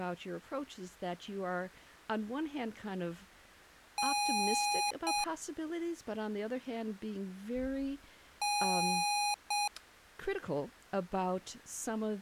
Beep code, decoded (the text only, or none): 1 long, 1 short